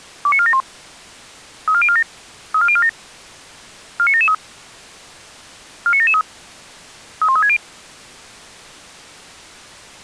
Five-tone selective call (ZVEI), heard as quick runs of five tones, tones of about 70 ms. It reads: 29471 34047 34047 49773 49773 31360